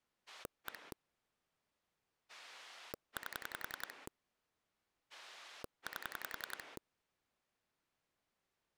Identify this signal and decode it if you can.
Pulse dialling, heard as a rotary dial, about 10 pulses a second. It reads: 1 8 8